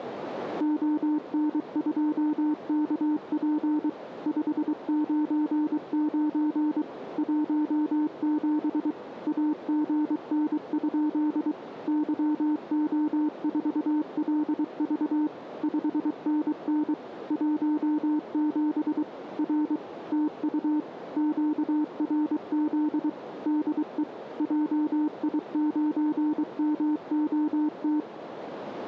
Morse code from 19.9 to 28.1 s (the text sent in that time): TU QRZ DE JI9MOT